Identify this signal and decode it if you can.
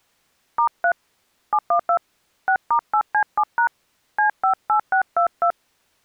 DTMF, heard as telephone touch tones, dialled by hand, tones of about 90 ms. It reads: *3 712 6*8C7# C58622